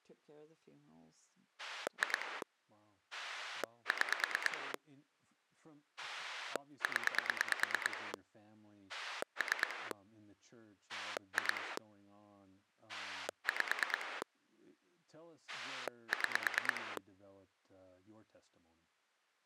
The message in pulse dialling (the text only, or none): 2 6 0 3 2 5 6